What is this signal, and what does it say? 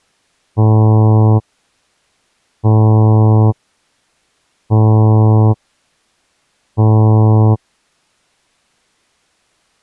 Ship horn signal, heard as a ship's horn, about 110 Hz. 4 short. At sea: a pilot vessel's identity signal in fog.